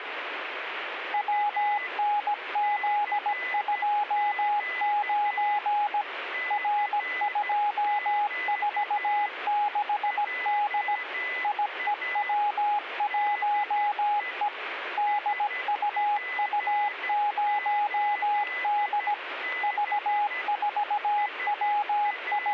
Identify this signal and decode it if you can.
Morse code, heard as a keyed tone, machine-sent, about 17 wpm, 830 Hz, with radio static and a weaker station near 2010 Hz. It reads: WNZ29 R246D IEW1E DUU0D …